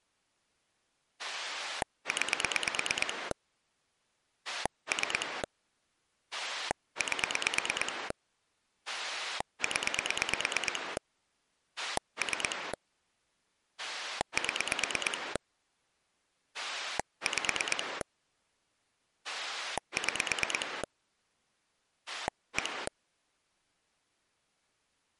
Pulse dialling, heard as a rotary dial, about 9 pulses a second. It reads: 9 3 8 0 3 7 5 6 1